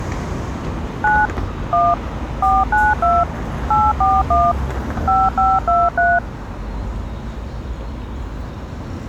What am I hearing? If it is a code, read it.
DTMF, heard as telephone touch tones, dialled by machine, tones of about 210 ms, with street noise. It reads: 9 1 492 841 5523